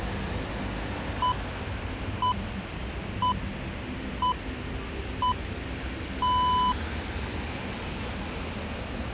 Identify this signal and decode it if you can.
Radio time signal (six pips, as the Greenwich Time Signal), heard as pips, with street noise.